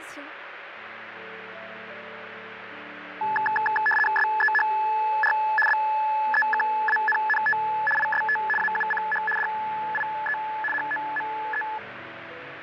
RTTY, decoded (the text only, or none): SEHR BEKANNT IST AUCH DIE HOME